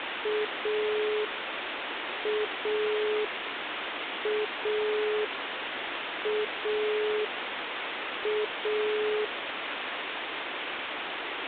Telephone call progress tone (pulsed, as in Italy), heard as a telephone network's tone, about 420 Hz, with phone line noise. Dial tone.